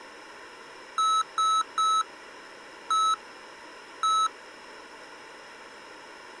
Beep code, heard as beeps from a small speaker, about 1300 Hz. 3-1-1. In Phoenix BIOS tables: DMA register failure.